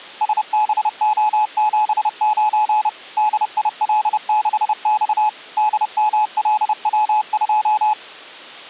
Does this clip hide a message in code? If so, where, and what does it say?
Yes: Morse code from 0.2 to 8.0 s, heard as a keyed tone, machine-sent, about 30 wpm, 850 Hz. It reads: SBO79 DIL6X DMLW2